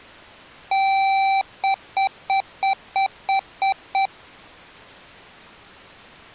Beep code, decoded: 1 long, 8 short

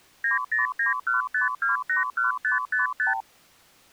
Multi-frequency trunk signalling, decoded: 90915281555

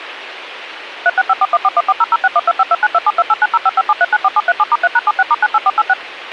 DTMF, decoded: 3654141400612529272890557394737*3#76*98486

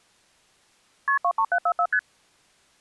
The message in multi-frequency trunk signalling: KP 23744 ST

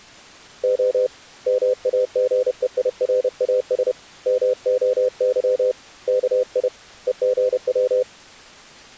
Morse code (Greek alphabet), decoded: Ο ΜΑΓΕΙΡΑΣ ΜΟΥ ΚΙ ΕΓΩ

